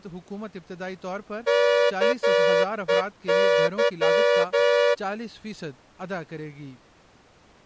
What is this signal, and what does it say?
Morse code, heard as a horn, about 11 wpm. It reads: KEY